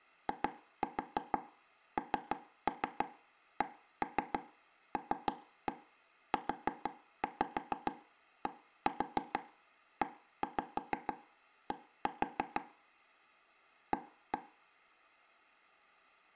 Tap code, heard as taps on a table, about 6 knocks a second, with room echo. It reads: INCLUDED A